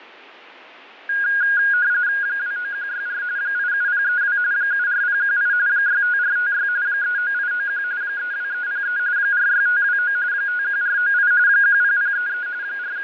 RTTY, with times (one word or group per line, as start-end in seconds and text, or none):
2.2-3.2 29164
3.4-4.4 87032
4.5-5.5 74018
5.7-6.7 65456
6.9-7.8 39891
8.0-9.0 32303
9.2-10.2 46529
10.3-11.3 51498
11.5-12.5 10033
12.6-13.0 …